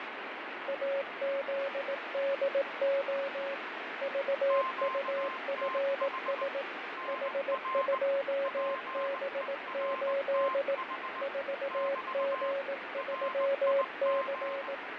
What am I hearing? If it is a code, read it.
Morse code, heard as two keyed tones, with heavy radio static and fading. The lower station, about 18 wpm, 550 Hz: AZDO VUFS H2B8 4G3C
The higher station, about 19 wpm, 1050 Hz: QTH NR PERTH <BT> RIG